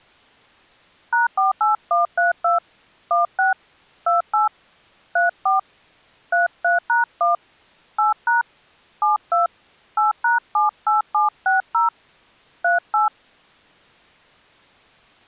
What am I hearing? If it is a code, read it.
DTMF, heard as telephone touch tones, dialled by hand, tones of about 140 ms. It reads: #48132 16 28 34 33#1 8# 72 8#78760 38